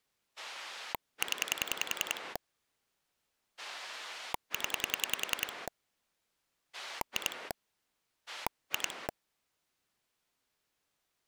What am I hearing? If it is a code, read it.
Pulse dialling, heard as a rotary dial, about 10 pulses a second. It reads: 0 0 2 2